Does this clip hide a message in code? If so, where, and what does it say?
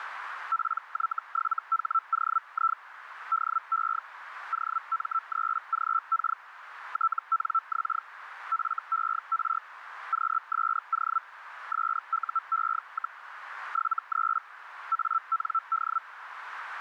Yes: Hellschreiber (Feld-Hell, 122.5 baud) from 0.5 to 16.0 s, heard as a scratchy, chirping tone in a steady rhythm, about 1330 Hz, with radio static and a narrow filter. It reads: PY7HOI DE OM3GK TNX FER QSO SUE, 73 AND